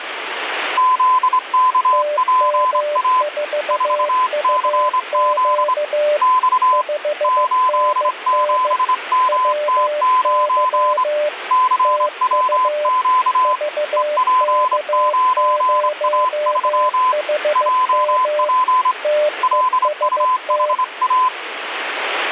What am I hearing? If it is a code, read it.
Morse code, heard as two keyed tones, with radio static. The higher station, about 25 wpm, 1020 Hz: ZKPA 4CZ X 87MT9 CWQ EP9A3 JP LUHA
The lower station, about 15 wpm, 600 Hz: TM4UQ 5NN WY TU VK0HM TEST